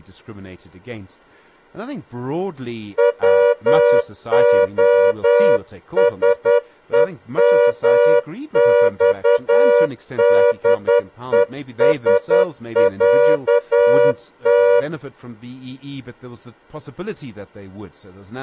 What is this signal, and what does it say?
Morse code (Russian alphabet), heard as a horn, hand-sent with a straight key, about 10 wpm, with speech in English. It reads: ВОСЕМЬДЕСЯТ